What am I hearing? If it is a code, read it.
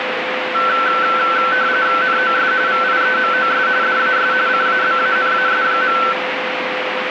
RTTY (45.45 baud, 170 Hz shift), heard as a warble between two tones, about 1430 Hz centre, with radio static and a steady whistle near 510 Hz. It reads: NOS VIEMOS DAS CABANAS.